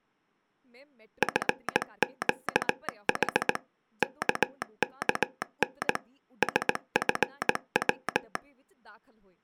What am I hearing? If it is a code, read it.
Morse code, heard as a telegraph sounder, machine-sent, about 18 wpm, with speech in Punjabi. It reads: FQH KKN SFW